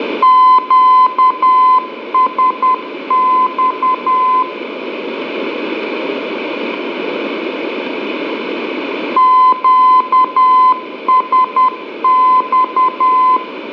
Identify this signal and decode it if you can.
Morse code, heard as a keyed tone, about 10 wpm, 1020 Hz, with radio static and room echo. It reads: QSX QSX